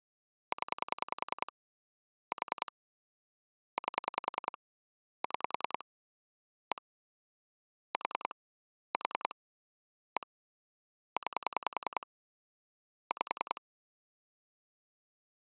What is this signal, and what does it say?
Pulse dialling, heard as clicks on a phone line, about 10 pulses a second. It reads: 0 4 8 6 1 4 4 1 9 5